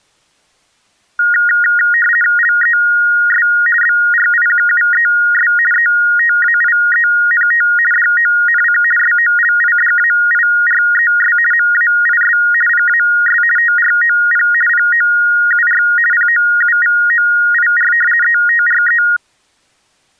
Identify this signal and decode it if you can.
RTTY (50 baud, 450 Hz shift), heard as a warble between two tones, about 1650 Hz centre. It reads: LES BRIQUES ETAIENT DONC SOLIDAIRES MAIS PAS TROP POUR POUVOIR ETRE